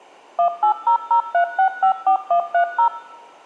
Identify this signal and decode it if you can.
DTMF, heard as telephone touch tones, dialled by machine, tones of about 100 ms. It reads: 18003654130